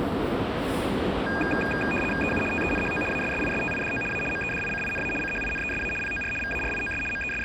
RTTY (75 baud, 850 Hz shift), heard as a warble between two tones, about 2050 Hz centre, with radio static and the noise of a subway station. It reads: EU TENHO ASSISTIDO A MEDICINA CHINESA POR VARIOS …